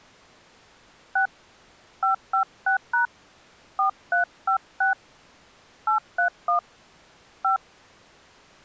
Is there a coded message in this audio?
Yes: DTMF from 1.2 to 7.6 s, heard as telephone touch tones, dialled by hand, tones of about 120 ms. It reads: 6 556# 4356 831 5